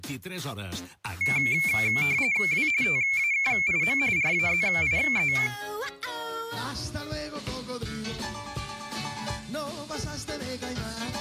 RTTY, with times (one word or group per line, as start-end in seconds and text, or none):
2.5-2.7 W
2.8-4.0 TAKIM
4.2-5.3 RAZIE